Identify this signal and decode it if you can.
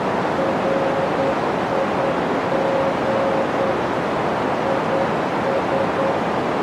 Morse code, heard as a keyed tone, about 9 wpm, 540 Hz, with heavy radio static and a narrow filter. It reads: RIG IS